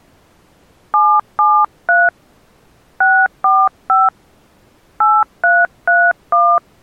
DTMF, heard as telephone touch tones, dialled by hand, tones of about 220 ms. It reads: 773 645 8331